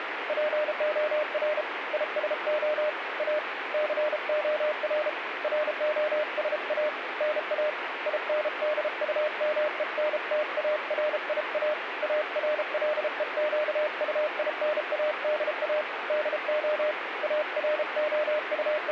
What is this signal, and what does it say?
Morse code, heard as a keyed tone, hand-sent with a paddle, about 33 wpm, 610 Hz, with radio static. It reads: POR ISO A COR ROSA NA INDUMENTARIA ARLEQUINADA DO …